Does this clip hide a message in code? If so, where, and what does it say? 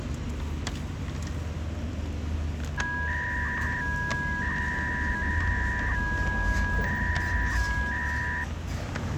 Yes: 300-baud modem data (V.21 tones) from 2.8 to 8.4 s, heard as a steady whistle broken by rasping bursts, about 300 baud, 200 Hz shift, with street noise.